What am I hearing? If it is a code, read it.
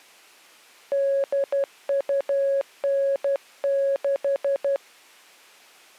Morse code (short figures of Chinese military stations), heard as a keyed tone, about 12 wpm, 550 Hz. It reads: 8296